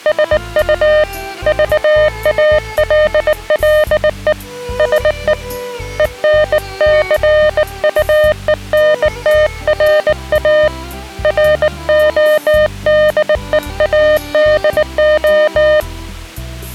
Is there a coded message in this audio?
Yes: Morse code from 0.0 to 15.9 s, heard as a keyed tone, hand-sent with a bug key, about 19 wpm, 610 Hz. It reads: SU VALLE SE ENCUENTRA RODEADO